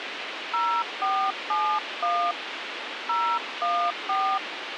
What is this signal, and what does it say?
DTMF, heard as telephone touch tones, dialled by hand, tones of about 290 ms, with radio hiss. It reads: 0471 014